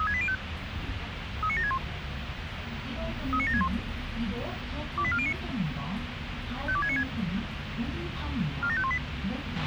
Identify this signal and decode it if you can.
Five-tone selective call (ZVEI), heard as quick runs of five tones, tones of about 70 ms, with radio hiss, a squelch burst at the end and the noise inside a bus. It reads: 36805 39761 39761 28409 52696 47518